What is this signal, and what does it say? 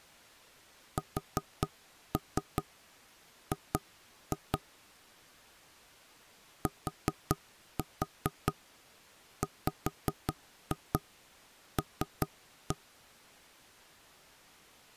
Tap code, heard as knocks on wood, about 4 knocks a second. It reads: SG TWL